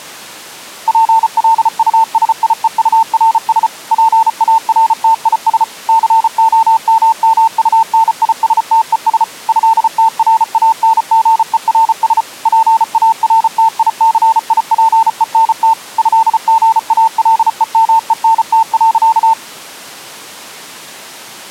Morse code (with French letters), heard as a keyed tone, machine-sent, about 34 wpm, 900 Hz. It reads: PLUSIEURS PARTIS COMMUNISTES ÉTRANGERS PARTICIPENT ÉGALEMENT.